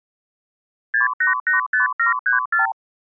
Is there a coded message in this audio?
Yes: multi-frequency trunk signalling (R2, with the far end's replies) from 0.9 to 2.7 s, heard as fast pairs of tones, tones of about 130 ms. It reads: 6885734